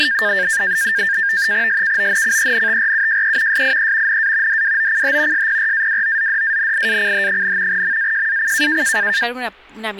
NAVTEX (SITOR-B), 100 baud, 170 Hz shift, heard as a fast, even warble, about 1700 Hz centre, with speech in Spanish. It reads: SKONCENTRUJE SIE NA DWOCH SPRAWOZDANIACH, MAJAC